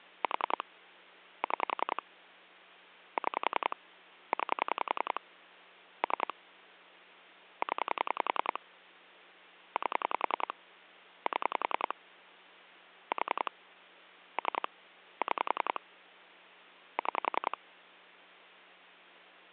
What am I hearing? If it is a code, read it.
Pulse dialling, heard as clicks on a phone line, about 10 pulses a second, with hum. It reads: 4 6 6 9 3 0 8 7 4 3 6 6